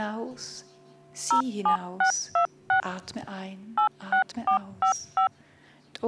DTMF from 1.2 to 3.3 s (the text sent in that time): 07626